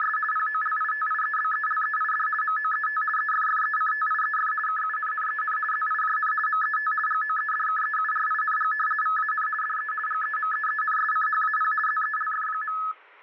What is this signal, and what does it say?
RTTY (50 baud, 450 Hz shift), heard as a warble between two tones, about 1500 Hz centre. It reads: … POLITIEBELEID MOET EFFECTIEF KUNNEN ZIJN MET GOEDKEURING VAN DE GEMEENSCHAP ZELF.